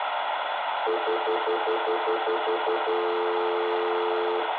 Telephone call progress tone (North American plan), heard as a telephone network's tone, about 350, 440 Hz, 0.1 s on and 0.1 s off, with phone line noise and room echo. Stutter dial tone.